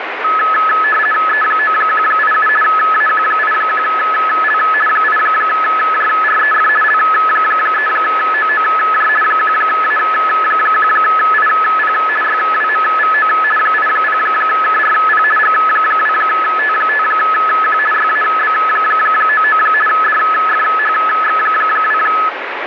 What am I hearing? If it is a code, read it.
RTTY (50 baud, 450 Hz shift), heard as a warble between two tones, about 1500 Hz centre, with radio static. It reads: E9187 AQ81L 8JREF L3OOJ 1A1IP YWMVO 80KRP G2T5Q YAB99 DFHX2